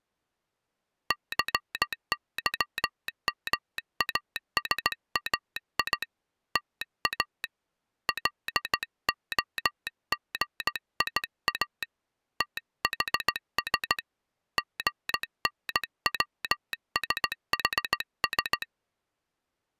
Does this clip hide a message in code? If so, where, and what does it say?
Yes: Morse code (Greek alphabet) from 1.0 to 18.7 s, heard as a telegraph sounder, hand-sent with a straight key, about 16 wpm. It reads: ΘΥΜΑΣΑΙ ΤΑ ΛΟΓΙΑ ΤΗΣ ΓΝΩΣΗΣ